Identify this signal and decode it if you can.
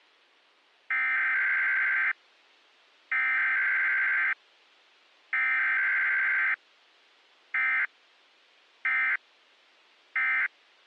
Emergency Alert System (SAME) tones (header bursts, then end-of-message bursts), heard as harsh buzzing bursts, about 520.83 baud.